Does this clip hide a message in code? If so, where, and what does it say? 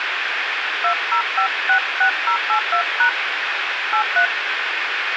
Yes: DTMF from 0.8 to 4.3 s, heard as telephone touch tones, dialled by hand, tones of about 90 ms, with radio hiss and room echo. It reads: 20566082# 83